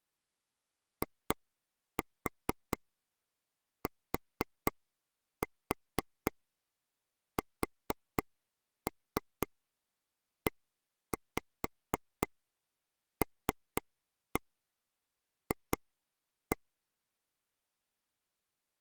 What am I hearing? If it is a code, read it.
Tap code, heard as taps on a table, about 4 knocks a second. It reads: ITSELF